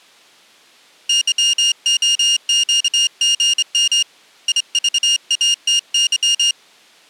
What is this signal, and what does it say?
Morse code, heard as a high beeper, hand-sent with a straight key, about 25 wpm, 2850 Hz. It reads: YOQGM IVATY